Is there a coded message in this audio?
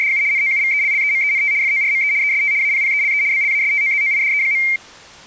Yes: RTTY (75 baud, 170 Hz shift) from 0.0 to 4.8 s, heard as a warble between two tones, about 2200 Hz centre. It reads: … NOUVELLEMENT FORME EST APPELE BLASTOZOIDE.